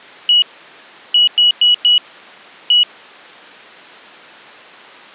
Beep code, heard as a piezo beeper, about 2900 Hz. 1-4-1. In Phoenix BIOS tables: address line failure in the first 64 KB of memory.